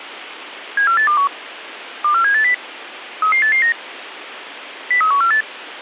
Five-tone selective call (CCIR), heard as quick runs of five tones, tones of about 100 ms, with radio hiss. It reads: 74821 24780 33889 03148